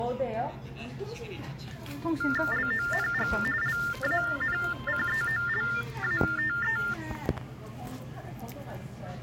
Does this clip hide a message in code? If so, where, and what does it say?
Yes: TTY/TDD text telephone tones (45.45 baud Baudot) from 2.2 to 6.9 s, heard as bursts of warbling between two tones, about 400 Hz shift, 1600 Hz centre, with the noise of a cafe. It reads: LONG LANCEOLATE